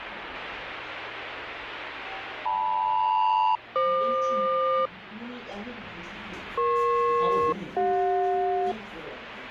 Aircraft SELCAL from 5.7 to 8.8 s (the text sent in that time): EP-CJ